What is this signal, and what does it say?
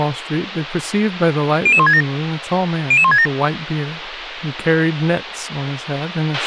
Five-tone selective call (ZVEI), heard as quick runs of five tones, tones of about 70 ms, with radio hiss, a squelch burst at the end and speech in English. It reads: 00167 00167